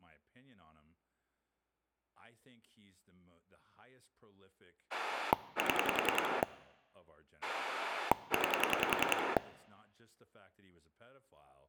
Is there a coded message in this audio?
Yes: pulse dialling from 4.9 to 9.4 s, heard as a rotary dial, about 10 pulses a second, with speech in English. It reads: 7 9